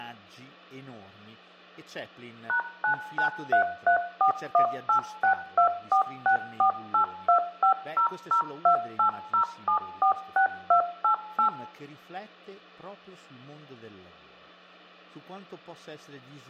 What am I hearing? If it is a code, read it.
DTMF, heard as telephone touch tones, dialled by machine, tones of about 100 ms, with hum, room echo and speech in Italian. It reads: #99334186246482500280746288